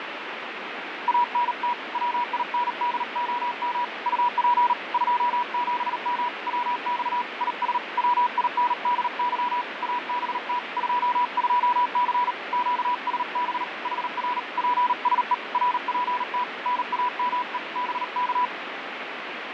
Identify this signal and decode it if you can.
Morse code, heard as a keyed tone, hand-sent with a paddle, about 38 wpm, 980 Hz, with radio static and fading. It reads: ANT WINDOM UP 27M WX IS WINDY ABT 22C QSB HR PSE RPT NAME BK